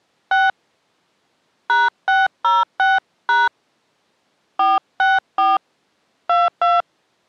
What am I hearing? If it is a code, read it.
DTMF, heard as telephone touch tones, dialled by hand, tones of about 190 ms. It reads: 6 #606# 464 22